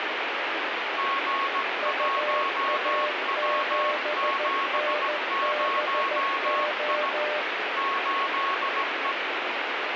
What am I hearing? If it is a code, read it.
Morse code, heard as two keyed tones, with heavy radio static. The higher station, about 17 wpm, 1100 Hz: G1W70I 8E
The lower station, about 14 wpm, 600 Hz: UA7NBO